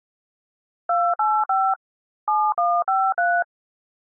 DTMF, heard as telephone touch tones, dialled by machine, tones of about 250 ms. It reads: 285 7153